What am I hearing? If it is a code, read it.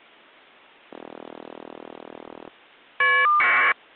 Caller ID data burst, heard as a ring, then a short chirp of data, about 1200 baud.